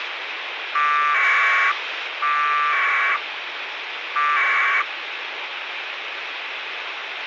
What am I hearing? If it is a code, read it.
Packet radio (AX.25, as in APRS), 1200 baud, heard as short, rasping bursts, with radio hiss.